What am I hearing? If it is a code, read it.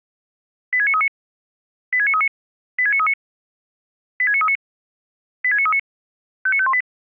Five-tone selective call (ZVEI), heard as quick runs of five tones, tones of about 70 ms. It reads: 86939 86939 86939 86939 86939 59518